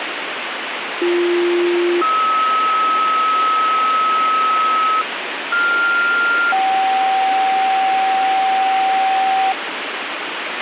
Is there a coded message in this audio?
Yes: two-tone page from 1.0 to 9.5 s, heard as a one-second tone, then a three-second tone, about 350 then 1290 Hz, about 1400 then 770 Hz, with radio hiss and a squelch burst at the end.